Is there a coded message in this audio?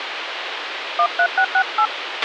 Yes: DTMF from 1.0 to 1.9 s, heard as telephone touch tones, dialled by hand, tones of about 70 ms, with radio hiss and a squelch burst at the end. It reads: 13668